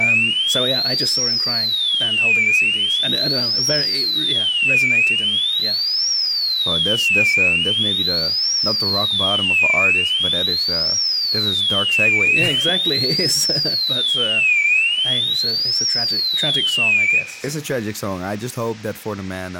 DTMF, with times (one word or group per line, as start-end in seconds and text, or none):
none